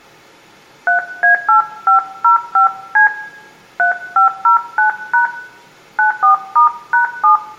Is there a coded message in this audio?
Yes: DTMF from 0.9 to 7.4 s, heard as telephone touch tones, dialled by hand, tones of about 120 ms, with room echo. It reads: 3A8505C 3509# 94*#7